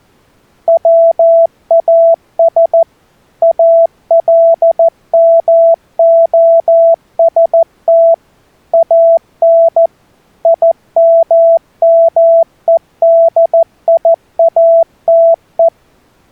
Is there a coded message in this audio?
Yes: Morse code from 0.6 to 15.7 s, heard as a keyed tone, machine-sent, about 14 wpm, 660 Hz. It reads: WAS ALMOST AN IMMEDIATE